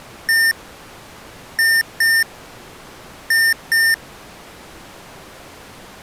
Beep code, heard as beeps from a small speaker, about 1800 Hz. 1-2-2. In Phoenix BIOS tables: DMA initialisation failure.